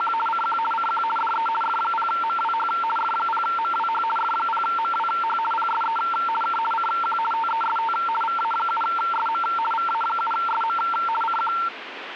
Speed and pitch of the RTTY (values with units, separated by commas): 50 baud, 450 Hz shift, 1130 Hz centre